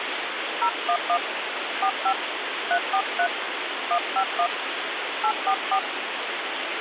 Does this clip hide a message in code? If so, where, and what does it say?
Yes: DTMF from 0.6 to 5.8 s, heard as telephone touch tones, dialled by hand, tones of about 80 ms, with phone line noise. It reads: 011 45 343 151 844